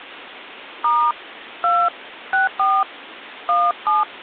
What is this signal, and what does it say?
DTMF, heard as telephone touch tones, dialled by hand, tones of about 180 ms. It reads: * 2 64 17